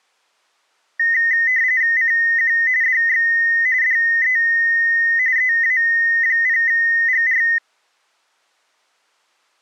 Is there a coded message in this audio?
Yes: RTTY (45.45 baud, 170 Hz shift) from 1.0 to 7.6 s, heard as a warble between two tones, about 1950 Hz centre. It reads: CQ DX DE EA0GR